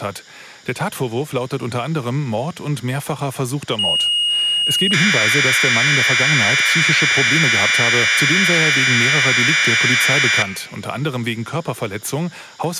Commodore tape loading (standard loader), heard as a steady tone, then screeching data, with room echo.